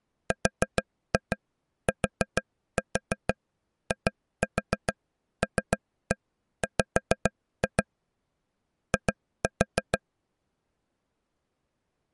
Tap code, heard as taps on a table, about 6 knocks a second. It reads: RTILW I